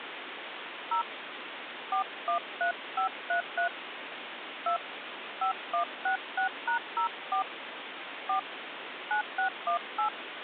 DTMF, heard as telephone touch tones, dialled by hand, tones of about 110 ms, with phone line noise. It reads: 0 413533 2 5166#04 4 9618